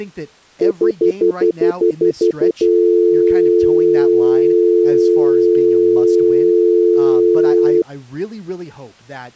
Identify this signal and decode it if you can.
Telephone call progress tone (North American plan), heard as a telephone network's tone, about 350, 440 Hz, 0.1 s on and 0.1 s off, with speech in English. Stutter dial tone.